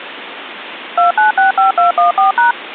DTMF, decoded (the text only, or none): 2965214#